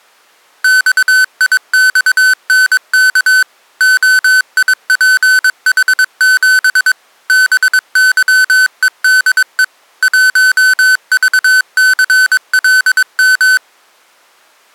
Morse code, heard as electronic beeps, machine-sent, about 22 wpm, 1500 Hz. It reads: XIXNK OIPH7 BYEDE 1VCLM